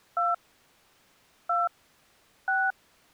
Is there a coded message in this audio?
Yes: DTMF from 0.2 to 2.7 s, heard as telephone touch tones, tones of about 220 ms. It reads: 2 2 6